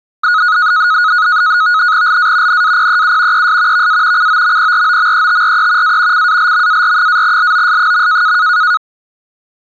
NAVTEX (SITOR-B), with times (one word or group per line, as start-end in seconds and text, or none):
2.1-2.6 LA
2.5-3.5 NAPEU
3.3-3.9 ES
3.7-4.3 VA
4.2-6.0 COMPROMETRE
5.8-6.3 A
6.1-8.4 CALMAR-LOS.